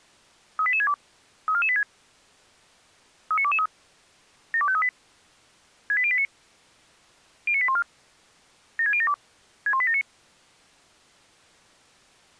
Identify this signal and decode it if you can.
Five-tone selective call (ZVEI), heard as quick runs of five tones, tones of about 70 ms. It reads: 38862 34486 39223 72538 68089 09814 76072 61879